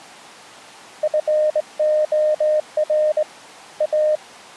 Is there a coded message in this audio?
Yes: Morse code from 1.0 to 4.2 s, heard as a keyed tone, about 21 wpm, 610 Hz. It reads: FOR A